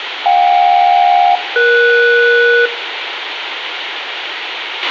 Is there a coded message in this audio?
Yes: aircraft SELCAL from 0.3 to 2.7 s, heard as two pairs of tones, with radio hiss, a squelch burst at the end and room echo. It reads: JK-ES